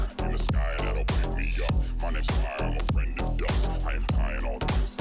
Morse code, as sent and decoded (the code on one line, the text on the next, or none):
none